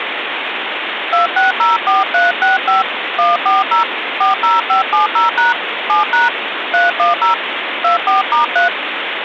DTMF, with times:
1.1-2.8 2604365
3.2-3.8 140
4.2-5.5 40570#
5.9-6.3 7#
6.7-7.3 310
7.8-8.7 24*3

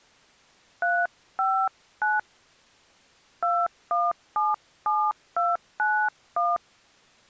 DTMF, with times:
0.8-2.2 359
3.4-6.6 2177291

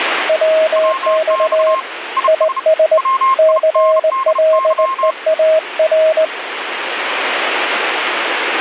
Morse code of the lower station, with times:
0.3-1.7 WX
2.3-3.0 IS
3.4-6.2 CLEAR

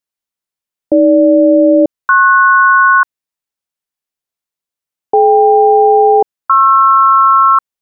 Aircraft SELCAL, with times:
0.9-3.0 AG-PS
5.1-7.6 DK-PR

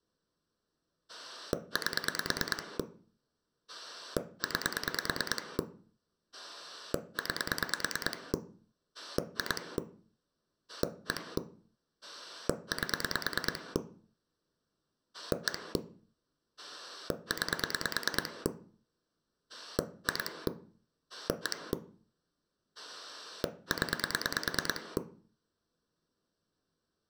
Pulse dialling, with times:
1.1-2.8 8
3.7-5.6 9
6.3-8.3 9
8.9-9.8 2
10.7-11.4 1
12.0-13.8 8
15.1-15.8 1
16.6-18.5 9
19.5-20.5 2
21.1-21.7 1
22.8-25.0 0

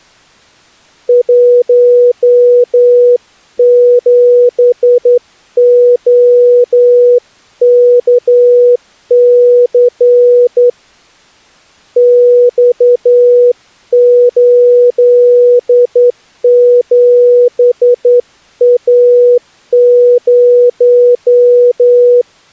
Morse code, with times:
1.1-10.7 17OKC
12.0-22.2 X87A0

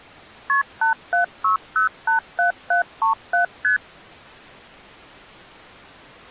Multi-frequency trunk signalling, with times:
0.5-0.6 KP
0.8-3.4 876087737
3.6-3.8 ST

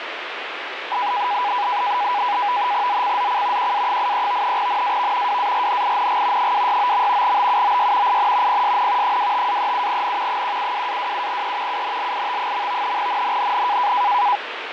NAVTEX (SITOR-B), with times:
2.9-3.7 ZCZC
3.6-4.6 QA83
4.6-5.4 NAV
5.3-6.5 WARNING
6.4-7.4 269.
7.2-8.2 BUOY
8.1-8.6 IN
8.5-9.2 PSN
9.0-10.4 25-37N
10.3-11.8 172-27E
11.7-13.0 UNLIT.
13.0-13.9 NNNN

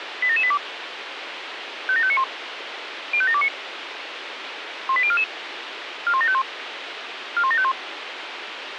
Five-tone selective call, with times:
0.2-0.6 87782
1.9-2.2 57591
3.1-3.5 05729
4.9-5.2 18044
6.1-6.4 41751
7.4-7.7 41751

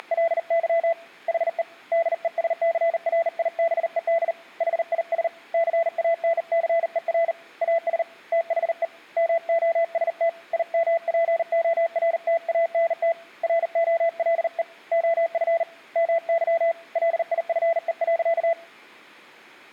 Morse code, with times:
0.0-0.9 …
1.3-1.6 HE
1.9-4.3 DESCRIBED
4.6-5.3 HIS
5.5-7.3 CANCER
7.6-8.0 AS
8.3-8.8 THE
9.2-10.3 MOST
10.5-13.1 IMPORTANT
13.4-14.6 ROLE
14.9-15.6 OF
16.0-16.7 MY
17.0-18.5 LIFE.

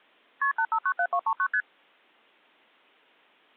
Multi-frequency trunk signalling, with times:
0.4-0.5 KP
0.6-1.5 8597239
1.5-1.6 ST

